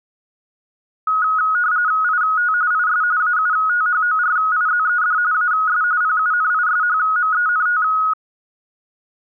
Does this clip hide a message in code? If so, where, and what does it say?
Yes: RTTY (45.45 baud, 170 Hz shift) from 1.1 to 8.1 s, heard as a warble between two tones, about 1360 Hz centre. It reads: IT IS AUTHORIZED AS PUNISHMENT